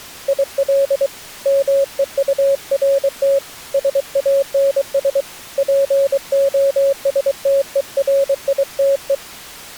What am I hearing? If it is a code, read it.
Morse code, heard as a keyed tone, hand-sent with a paddle, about 23 wpm, 550 Hz. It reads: IL MEURT SANS POSTERITE